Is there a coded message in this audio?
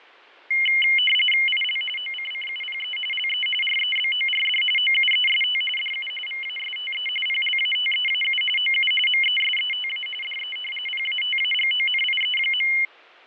Yes: RTTY (45.45 baud, 850 Hz shift) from 0.5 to 12.9 s, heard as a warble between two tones, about 2550 Hz centre, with fading. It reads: IL OCCUPE LE REBORD OUEST DU VASTE PLATEAU OU MESETA DE PATAGONIE.